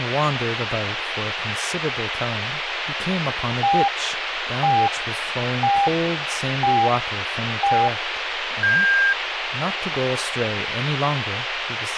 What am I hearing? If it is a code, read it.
Radio time signal (five pips and a higher one, as on Chinese radio), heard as pips, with radio hiss and speech in English.